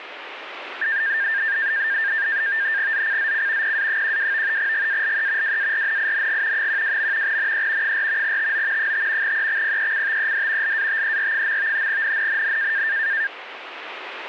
NAVTEX (SITOR-B), 100 baud, 170 Hz shift, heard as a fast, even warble, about 1700 Hz centre, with radio static. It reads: ZCZC PA12 GALE WARNING 12. NE 4 TO 5 EXPECTED LATER. NNNN